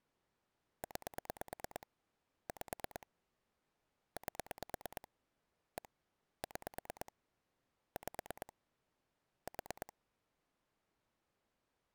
Pulse dialling, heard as clicks on a phone line, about 9 pulses a second. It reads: 9 5 8 1 6 5 4